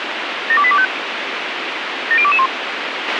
Five-tone selective call (ZVEI), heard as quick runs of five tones, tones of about 70 ms, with radio hiss and a squelch burst at the end. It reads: 72825 70221